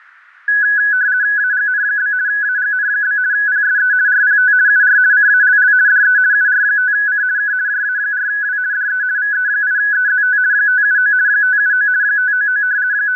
RTTY (50 baud, 170 Hz shift), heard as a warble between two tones, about 1600 Hz centre. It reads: AGN? AGN? PSE RPT UR CALL DE UR5C K JA4W DE VE8EZT 579 579 599 …